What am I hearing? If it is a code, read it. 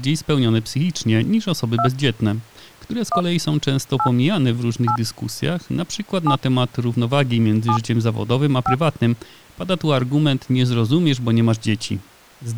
DTMF, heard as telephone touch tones, dialled by hand, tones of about 80 ms, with speech in Polish. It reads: 2 1 8 8 7 7 5